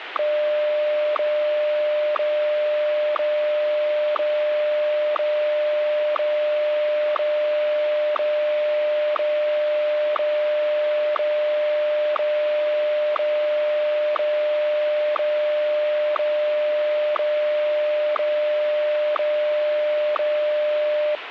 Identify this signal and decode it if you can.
Radio time signal (WWVH, Hawaii), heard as ticks, one a second, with radio static.